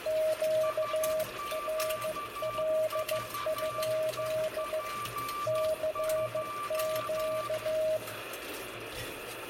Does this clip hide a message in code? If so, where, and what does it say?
Yes: Morse code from 0.0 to 8.0 s, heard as two keyed tones, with radio static, room echo and kitchen noise. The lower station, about 15 wpm, 630 Hz: QRL? CQ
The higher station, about 12 wpm, 1170 Hz: SQVEP2